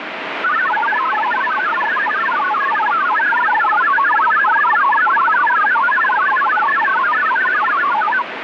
Multi-tone FSK (Olivia or MFSK type), about 1000 Hz wide, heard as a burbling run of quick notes, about 62.5 baud, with radio static.